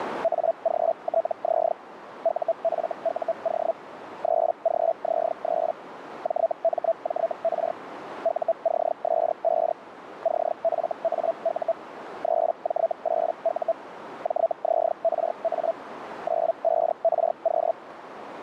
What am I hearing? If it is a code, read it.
Hellschreiber (Feld-Hell, 122.5 baud), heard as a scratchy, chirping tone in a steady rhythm, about 660 Hz, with radio static and a narrow filter. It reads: AGTZ UFUO 3GZ3 JMJR UCS5 CFAU 3J8U JZRA 95RQ